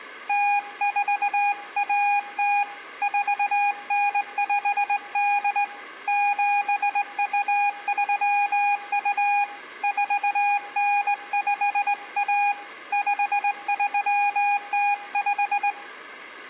Morse code (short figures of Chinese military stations), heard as a keyed tone, hand-sent with a straight key, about 19 wpm, 820 Hz, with room echo. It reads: 0410 4958 7232 4951 5305